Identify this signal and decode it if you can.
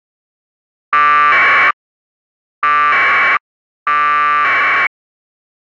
Packet radio (AX.25, as in APRS), 1200 baud, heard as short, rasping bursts.